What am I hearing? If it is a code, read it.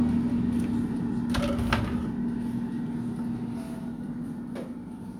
Kitchen noise. There is no code.